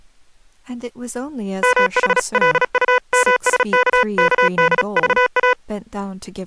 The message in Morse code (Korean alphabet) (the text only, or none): 무기명으로